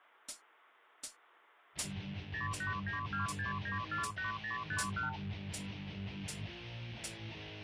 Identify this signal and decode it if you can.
Multi-frequency trunk signalling (R2, with the far end's replies), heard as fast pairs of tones, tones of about 130 ms. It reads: 08926948051